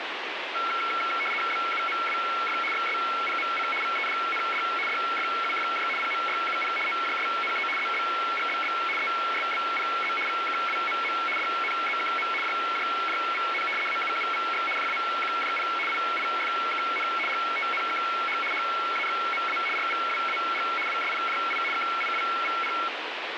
RTTY (75 baud, 850 Hz shift), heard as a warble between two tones, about 1800 Hz centre, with radio static. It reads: BUMWF XSPMC VEDND DFUFJ PMYUP OJSNE ZBGBB ESBPZ VKWMM DNZKM JJJVN AUUVX JAQJP IIFKN GTNKH HAXMA RVWAG WSPJI KIWVP